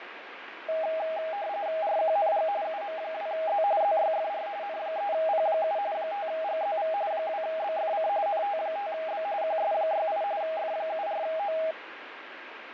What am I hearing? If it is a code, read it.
RTTY (45.45 baud, 170 Hz shift), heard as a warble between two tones, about 720 Hz centre, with radio static and fading. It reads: RQNG UM2Z ZYFR N3P7 5GZV 2BFC NT5B QS68 F74O